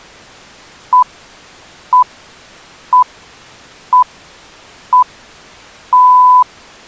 Radio time signal (six pips, as the Greenwich Time Signal), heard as pips.